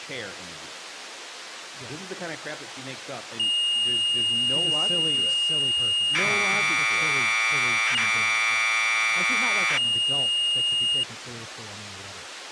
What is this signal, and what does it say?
Commodore tape loading (standard loader), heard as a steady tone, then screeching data, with speech in English.